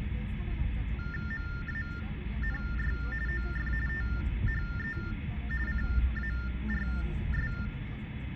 TTY/TDD text telephone tones (45.45 baud Baudot), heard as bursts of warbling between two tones, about 400 Hz shift, 1600 Hz centre, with phone line noise and the noise inside a car. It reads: MANY OF THE CARS